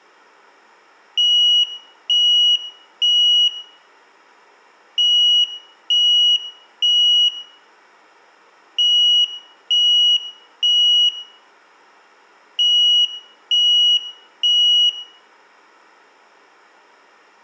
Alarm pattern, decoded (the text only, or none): temporal three